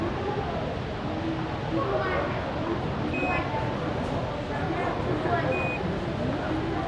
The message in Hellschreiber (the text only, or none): none